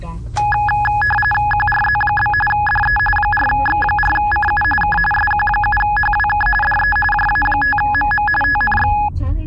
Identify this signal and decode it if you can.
RTTY (45.45 baud, 850 Hz shift), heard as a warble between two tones, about 1260 Hz centre, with the noise inside a car. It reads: QRZ? DE 4X4CU K SQ7HWK DE JA5MM TNX